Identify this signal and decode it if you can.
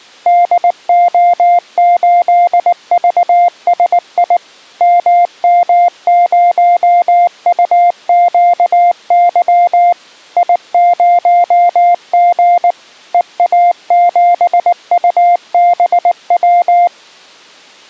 Morse code, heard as a keyed tone, machine-sent, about 19 wpm, 700 Hz. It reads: DO8VSI MM0UQY I0G EA7UBW